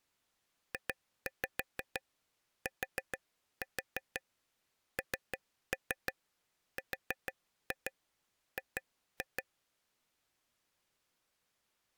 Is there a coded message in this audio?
Yes: tap code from 0.7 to 9.4 s, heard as taps on a table, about 6 knocks a second. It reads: JTNRG